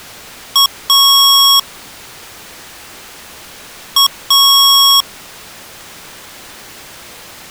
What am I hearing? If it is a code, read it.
Beep code, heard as beeps from a small speaker, played twice, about 1100 Hz. 1 short, 1 long.